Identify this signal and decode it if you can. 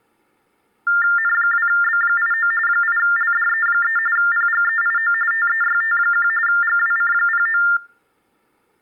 TTY/TDD text telephone tones (45.45 baud Baudot), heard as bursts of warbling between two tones, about 400 Hz shift, 1600 Hz centre. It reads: N2B89 8LDE3 PGEIO TEYT1 GWC09